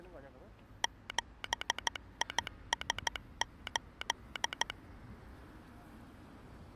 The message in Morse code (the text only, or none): 7IS8